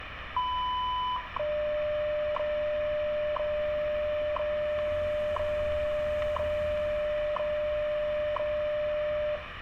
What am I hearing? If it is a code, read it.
Radio time signal (WWV, Colorado), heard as ticks, one a second, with radio static, room echo and street noise.